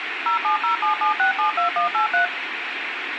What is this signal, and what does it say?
DTMF, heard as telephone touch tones, dialled by machine, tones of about 120 ms, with radio hiss and room echo. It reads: 07077672183